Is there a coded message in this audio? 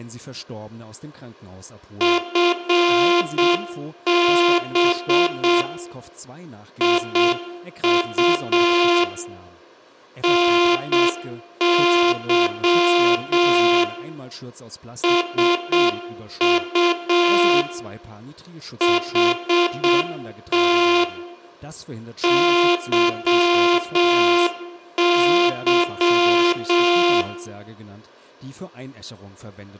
Yes: Morse code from 1.9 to 27.3 s, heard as a buzzer, machine-sent, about 7 wpm, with room echo and speech in German. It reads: FB IU NY SU HT YY